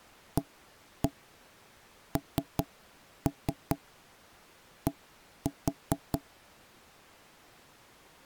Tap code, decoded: AND

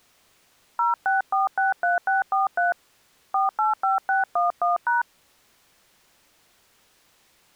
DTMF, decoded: 06463643 485611#

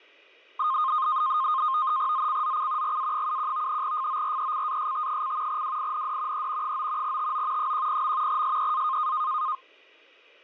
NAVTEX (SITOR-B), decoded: ZCZC GA71 FORECAST: WIND E 9 TO 10. SEA

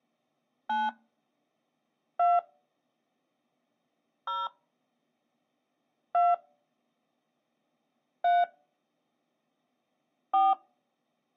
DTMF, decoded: 9 2 0 2 3 4

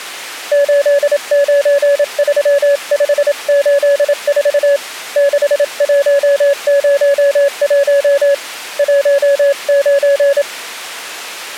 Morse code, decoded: 893584 6101 19

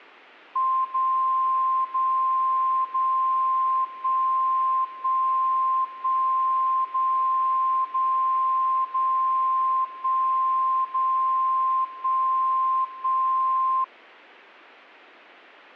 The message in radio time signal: 0 0 0 1 1 1 0 0 0 1 0 1 1

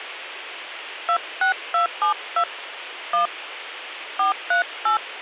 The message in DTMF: 26272 1 438

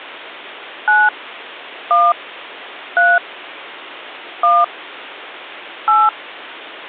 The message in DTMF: 9 1 3 1 8

